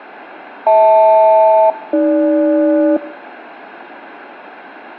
Aircraft SELCAL, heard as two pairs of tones, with radio static. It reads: HL-AG